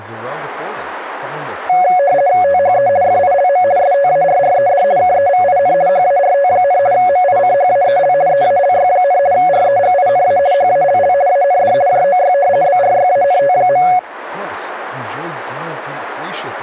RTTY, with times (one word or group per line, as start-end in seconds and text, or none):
2.4-2.9 THE
3.0-3.6 FILM
3.8-4.8 STARRED
5.0-5.7 KEVIN
5.9-6.8 HART,
6.9-8.1 MICHAEL
8.3-9.2 EALY,
9.3-10.4 REGINA
10.5-11.1 HALL
11.3-11.7 AND
11.9-12.3 JOY
12.6-13.8 BRYANT.